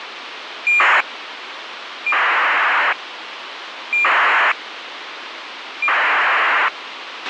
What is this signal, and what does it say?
ACARS aircraft data, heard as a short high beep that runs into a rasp, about 2400 baud, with radio hiss and a squelch burst at the end.